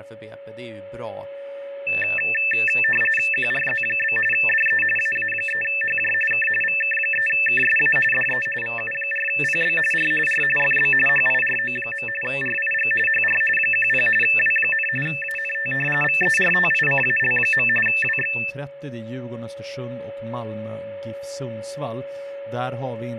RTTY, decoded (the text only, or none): QRZ? DE AA3HJ K VK3KSA DE VU4PB R R FB HIRO. RIG HR 10 W, ANT VERTICAL. WX